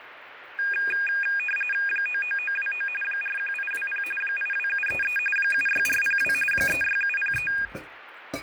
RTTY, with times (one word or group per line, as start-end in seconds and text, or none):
1.9-2.9 99929
3.0-4.0 41820
4.2-5.2 82733
5.4-6.3 76402
6.5-7.5 36703